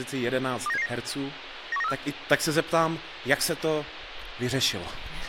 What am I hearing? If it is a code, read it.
Five-tone selective call (EEA), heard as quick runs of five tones, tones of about 40 ms, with radio hiss and speech in Czech. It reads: 29779 91934